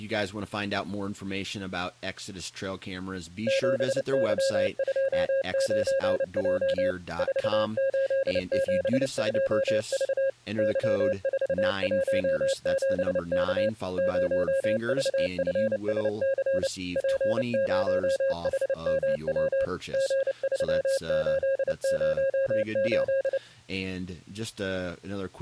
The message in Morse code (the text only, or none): 7Y29J 4872V Y417K 0VFSC P0HMW G3808